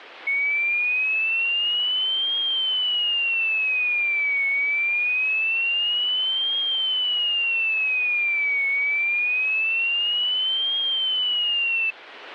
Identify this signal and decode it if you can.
A tone that sweeps in pitch again and again. There is no code.